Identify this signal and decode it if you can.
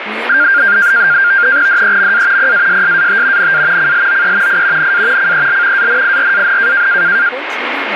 NAVTEX (SITOR-B), 100 baud, 170 Hz shift, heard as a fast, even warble, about 1500 Hz centre, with radio static and speech in Hindi. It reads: DEMA PASSAT NA CLOE I NA CEL ANIRAN